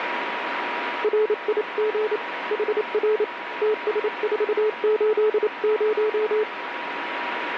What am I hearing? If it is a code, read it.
Morse code, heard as a keyed tone, hand-sent with a paddle, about 28 wpm, 430 Hz, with radio static and a steady whistle near 960 Hz. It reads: RIG HR TS480